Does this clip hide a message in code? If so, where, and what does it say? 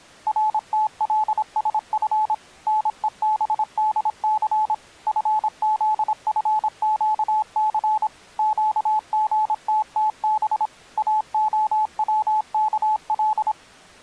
Yes: Morse code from 0.2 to 13.6 s, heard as a keyed tone, machine-sent, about 26 wpm, 860 Hz. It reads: RTLSF NEBDC FZFQC QGTTB AOWKL